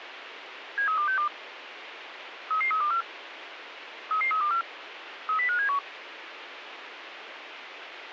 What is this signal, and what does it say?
Five-tone selective call (CCIR), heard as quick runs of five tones, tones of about 100 ms, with radio hiss. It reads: 73262 33324 33324 30571